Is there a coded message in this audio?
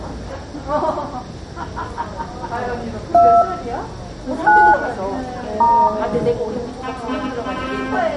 Yes: DTMF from 3.1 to 5.9 s, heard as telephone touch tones, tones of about 280 ms, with room echo and the noise of a subway station. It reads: 2 9 *